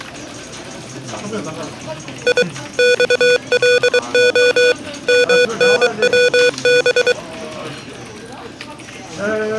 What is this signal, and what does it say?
Morse code, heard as electronic beeps, machine-sent, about 23 wpm, 490 Hz, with the noise of a crowd indoors. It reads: I XLO MNWB